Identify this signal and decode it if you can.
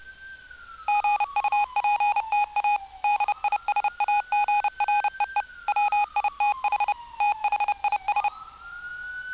Morse code, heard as electronic beeps, machine-sent, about 30 wpm, 830 Hz, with street noise. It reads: GUPTA DISAGREE WITH THIS